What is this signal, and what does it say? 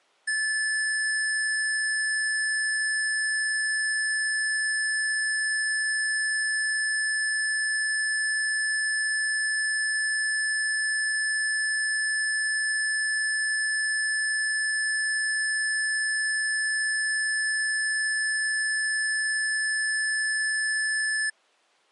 A steady tone. There is no code.